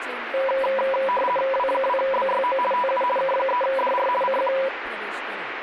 RTTY (50 baud, 450 Hz shift), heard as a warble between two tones, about 760 Hz centre, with radio static and speech in Marathi. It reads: W2BYO TU K3DR CQ